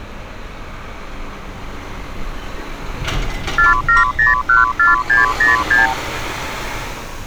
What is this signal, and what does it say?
Multi-frequency trunk signalling (R2, with the far end's replies), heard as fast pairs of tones, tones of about 150 ms, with street noise. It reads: 47014606